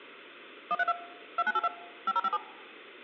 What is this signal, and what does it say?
DTMF, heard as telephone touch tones, dialled by machine, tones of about 40 ms. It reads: 132 2982 5057